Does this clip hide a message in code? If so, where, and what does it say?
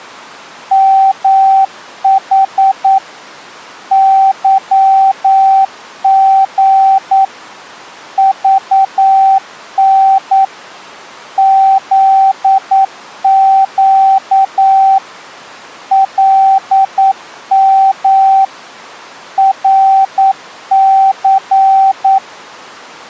Yes: Morse code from 0.7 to 22.2 s, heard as a keyed tone, machine-sent, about 9 wpm, 770 Hz. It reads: MH YG VN ZQ LM RC